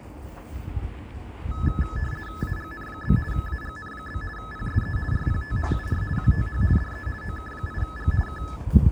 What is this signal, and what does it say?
RTTY (50 baud, 450 Hz shift), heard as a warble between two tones, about 1500 Hz centre, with static crashes and the noise of a residential street. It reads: AGN? AGN? PSE RPT UR QTH DE OK8G K